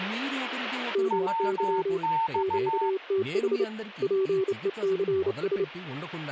Morse code, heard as two keyed tones, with speech in Telugu. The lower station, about 29 wpm, 380 Hz: MY QTH PECS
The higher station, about 15 wpm, 900 Hz: WX